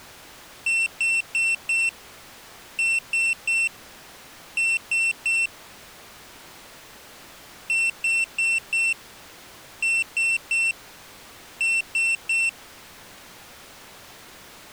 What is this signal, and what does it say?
Beep code, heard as a piezo beeper, played twice, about 2700 Hz. 4-3-3. In Phoenix BIOS tables: timer channel 2 failure.